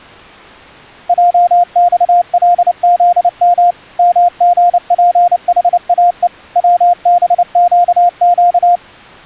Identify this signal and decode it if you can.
Morse code, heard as a keyed tone, machine-sent, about 29 wpm, 700 Hz. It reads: JXLZM MGPHAE WBQQ